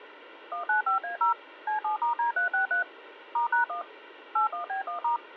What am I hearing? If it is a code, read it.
DTMF, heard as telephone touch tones, dialled by machine, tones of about 120 ms. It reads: 195A0 C7*D363 *#1 81B1*